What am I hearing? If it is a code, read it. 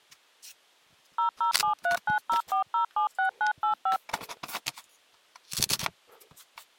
DTMF, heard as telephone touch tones, dialled by machine, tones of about 110 ms. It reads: 0073904076985